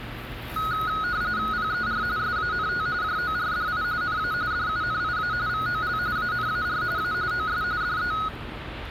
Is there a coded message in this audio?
Yes: RTTY (45.45 baud, 170 Hz shift) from 0.6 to 8.3 s, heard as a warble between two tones, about 1360 Hz centre, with street noise. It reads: PER SANT JORDI NA DUNIA VOL ANAR A OS DE